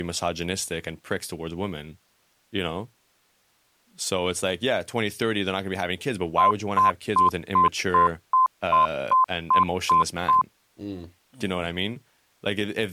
Beep code, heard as beeps, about 1030 Hz, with speech in English. 11 short. In AMI BIOS tables: cache memory error.